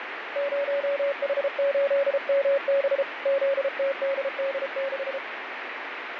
Morse code, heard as a keyed tone, hand-sent with a paddle, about 33 wpm, 550 Hz, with radio static and fading. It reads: 0H8MB ZTDD6